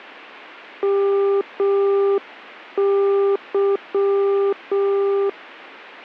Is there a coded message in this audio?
Yes: Morse code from 0.8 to 5.4 s, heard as a keyed tone, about 6 wpm, 400 Hz. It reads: MY